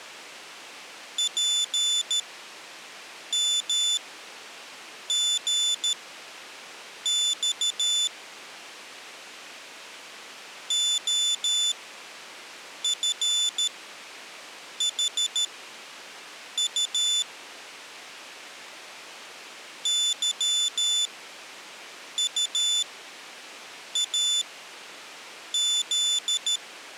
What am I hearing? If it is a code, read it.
Morse code, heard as a high beeper, machine-sent, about 13 wpm, spaced as for 6 wpm, 3500 Hz. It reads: PMGX OFHU YUAZ